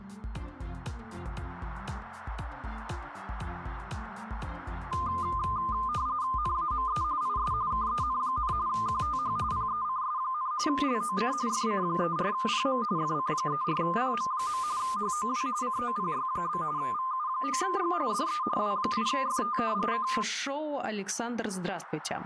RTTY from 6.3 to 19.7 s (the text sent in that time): NAME IS KEN, QTH PECS, LOC FC34PM FC34PM. HOW COPY? VU9G DE W8FT